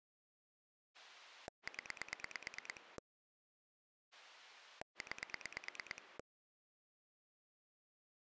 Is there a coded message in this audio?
Yes: pulse dialling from 0.9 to 6.2 s, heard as a rotary dial, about 9 pulses a second. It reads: 0 9